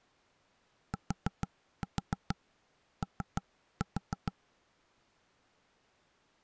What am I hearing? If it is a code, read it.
Tap code, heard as knocks on wood, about 6 knocks a second. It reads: TO